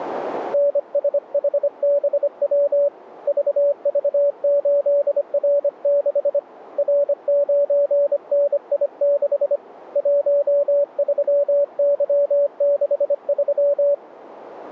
Morse code, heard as a keyed tone, hand-sent with a paddle, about 25 wpm, 570 Hz. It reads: NSHBW VV8R6 R9NI6 13Y63